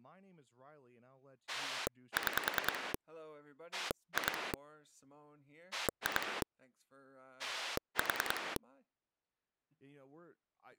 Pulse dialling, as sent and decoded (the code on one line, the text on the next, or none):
6 / 2 / 2 / 4
6 2 2 4